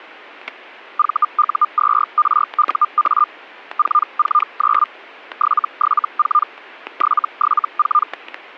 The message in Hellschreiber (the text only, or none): VU2RUA 449 774 774